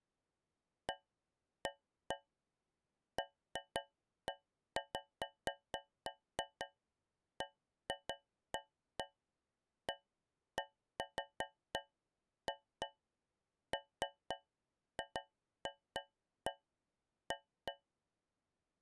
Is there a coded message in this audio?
No, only irregular taps on a metal pipe.